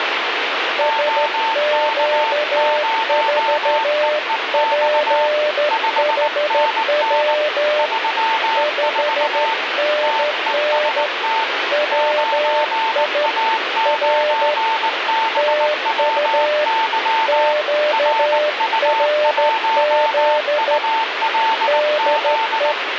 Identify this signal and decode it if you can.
Morse code, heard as two keyed tones, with radio static. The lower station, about 13 wpm, 600 Hz: SQ4PHW 5NN WI R TU QRZ DE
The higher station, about 19 wpm, 900 Hz: OK0EEX 5NN 34 TEST 9A9BWY RU1ULZ